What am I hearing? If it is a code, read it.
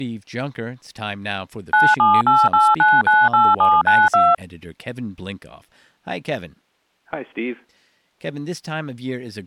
DTMF, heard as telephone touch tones, dialled by machine, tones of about 210 ms, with speech in English. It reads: 9788998792